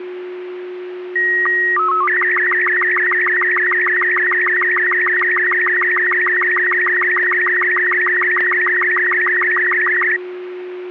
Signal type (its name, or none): SSTV (slow-scan television)